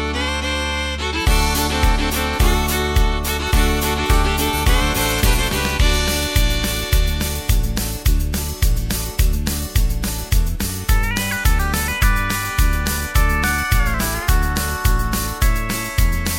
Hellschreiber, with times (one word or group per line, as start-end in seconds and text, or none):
none